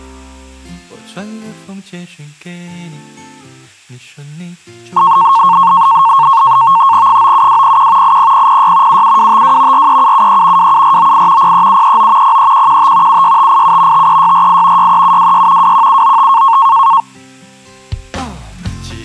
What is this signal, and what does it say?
NAVTEX (SITOR-B), 100 baud, 170 Hz shift, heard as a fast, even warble, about 1000 Hz centre. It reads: 97201 80006 77252 43773 27498 03739 03115 76587 53648 63726 21795